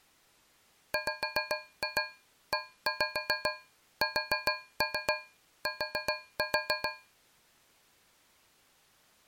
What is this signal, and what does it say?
Tap code, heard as taps on a metal pipe, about 7 knocks a second. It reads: WEST